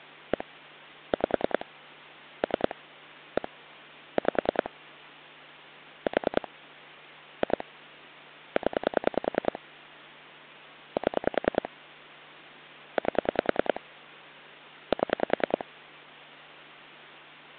Pulse dialling, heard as clicks on a phone line, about 10 pulses a second. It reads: 1 5 3 1 5 4 2 0 7 8 7